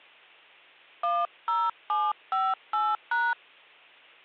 DTMF, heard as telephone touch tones, dialled by hand, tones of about 220 ms, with hum. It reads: 10758#